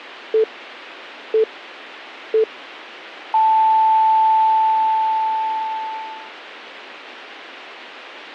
Radio time signal (three low pips and a long one an octave up, as on NHK), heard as pips.